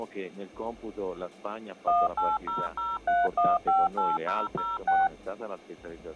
DTMF, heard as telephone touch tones, dialled by machine, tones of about 200 ms. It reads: 18003158006